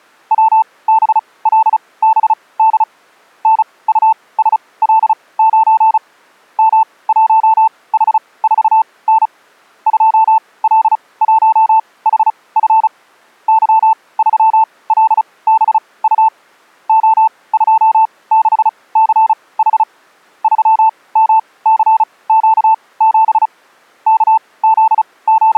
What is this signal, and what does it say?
Morse code, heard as a keyed tone, machine-sent, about 35 wpm, spaced as for 22 wpm, 880 Hz. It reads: WBLBD NUSL9 M1H4N 2L1HF Y3LBU O26CH 3MCQ7 …